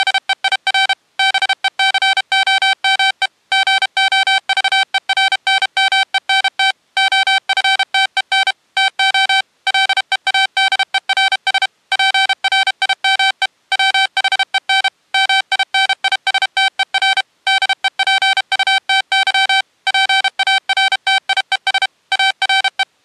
Morse code, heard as electronic beeps, machine-sent, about 32 wpm, 770 Hz. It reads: … BECOME GOVERNMENT OFTEN TO LEADERS PRIME WHEN MINISTER DEPUTY PARTIES ARE